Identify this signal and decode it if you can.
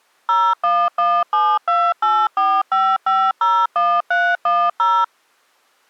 DTMF, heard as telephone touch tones, dialled by machine, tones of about 250 ms. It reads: 01172845501310